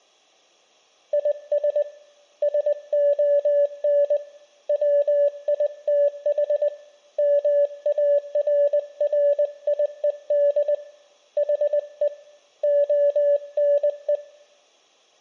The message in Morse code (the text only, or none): IS SON WITH MARRIED HE ONE